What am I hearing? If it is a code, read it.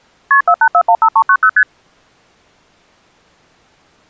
Multi-frequency trunk signalling (R1, as on North American trunks), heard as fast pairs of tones, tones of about 70 ms. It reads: KP 48415390 ST